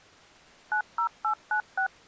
DTMF, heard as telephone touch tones, dialled by machine, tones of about 90 ms. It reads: 90896